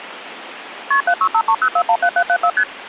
Multi-frequency trunk signalling (R1, as on North American trunks), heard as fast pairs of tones, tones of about 70 ms, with phone line noise. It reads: KP 76530417774 ST